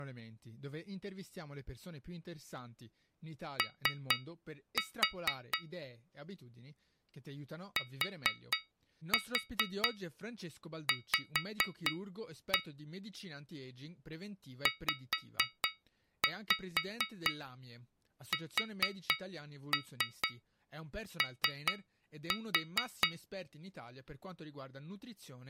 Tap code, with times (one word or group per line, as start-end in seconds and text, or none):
3.6-5.6 O
7.8-12.6 TV
14.7-23.1 ZSO